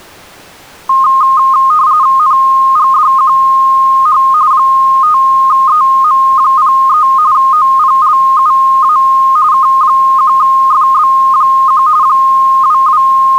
RTTY (45.45 baud, 170 Hz shift), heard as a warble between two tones, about 1150 Hz centre. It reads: NGDQH 5EM03 OPLUA K1FB1 …